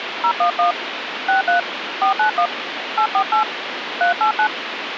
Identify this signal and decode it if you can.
DTMF, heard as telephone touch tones, dialled by hand, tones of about 100 ms, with phone line noise. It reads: 011 63 491 848 389